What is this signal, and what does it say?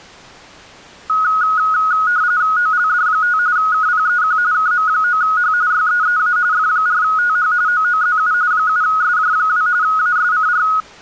RTTY (45.45 baud, 170 Hz shift), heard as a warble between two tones, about 1360 Hz centre. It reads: OLD5 KPEQ KM9H YEEA F4TH OOZU 7SJ2 ASCR